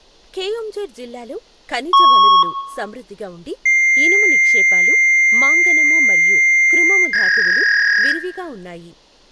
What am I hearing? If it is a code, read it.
Fax machine handshake, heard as a beep, a long tone and a warble, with room echo and speech in Telugu.